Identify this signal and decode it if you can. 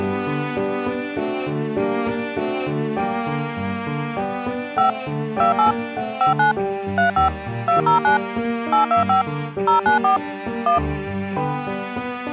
DTMF, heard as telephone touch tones, dialled by machine, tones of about 120 ms. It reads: 5 28 59 35 209 825 094 1